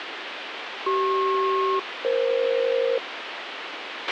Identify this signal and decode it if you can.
Aircraft SELCAL, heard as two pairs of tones, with radio hiss and a squelch burst at the end. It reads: CP-EF